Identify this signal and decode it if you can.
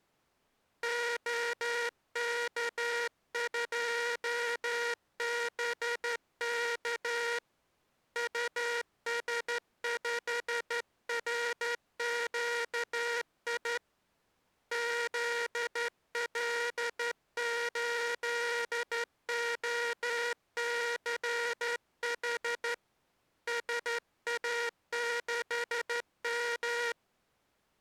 Morse code, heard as a buzzer, hand-sent with a straight key, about 12 wpm. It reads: OK2BK US5RQI ZL8OCH SA6M